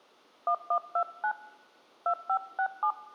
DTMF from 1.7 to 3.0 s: 2567

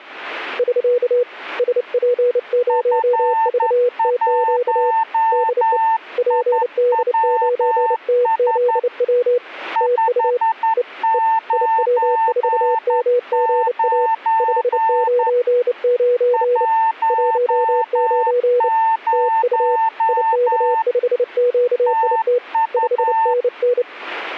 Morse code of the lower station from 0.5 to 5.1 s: <SK> SP0VTQ

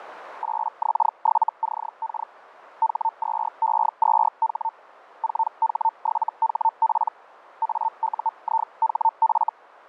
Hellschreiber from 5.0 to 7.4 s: 4H7HP

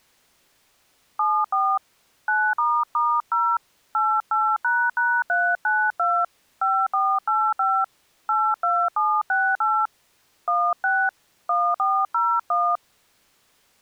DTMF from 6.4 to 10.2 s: 5485 82768

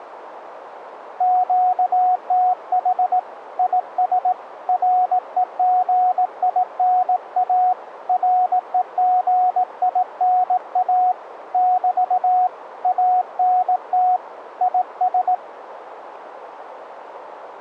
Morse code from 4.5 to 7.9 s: REGINA

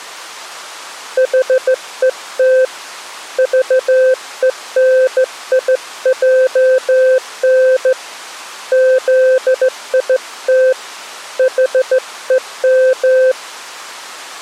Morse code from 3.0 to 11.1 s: VENIJN ZIT

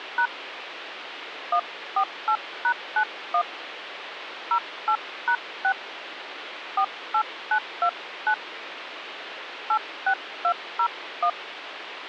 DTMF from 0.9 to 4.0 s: 148#91

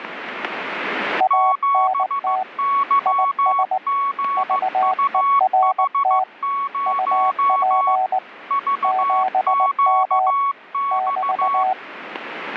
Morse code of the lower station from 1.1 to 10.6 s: ANT IS VERT UP 7M

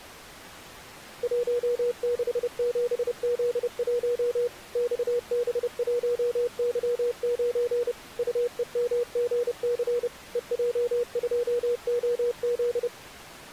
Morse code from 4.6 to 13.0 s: XB1Y9 UEMGC EJ2OZ

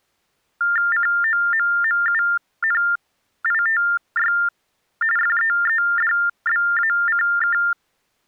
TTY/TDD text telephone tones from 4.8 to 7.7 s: FEEDBACK

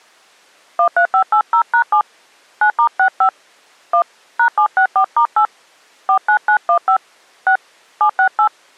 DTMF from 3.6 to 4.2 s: 1

